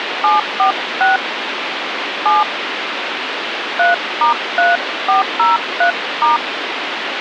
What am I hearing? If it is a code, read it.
DTMF, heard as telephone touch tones, dialled by hand, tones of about 130 ms, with phone line noise. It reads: 746 7 3*3403*